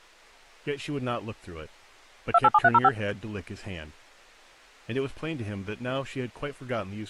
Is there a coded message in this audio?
Yes: DTMF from 2.3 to 2.9 s, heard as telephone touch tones, dialled by machine, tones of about 40 ms, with speech in English. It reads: 287305